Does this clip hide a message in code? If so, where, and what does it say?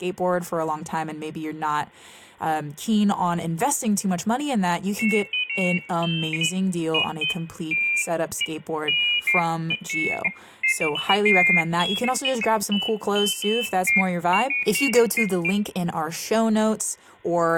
No, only pairs of high tones at irregular times, with room echo and speech in English.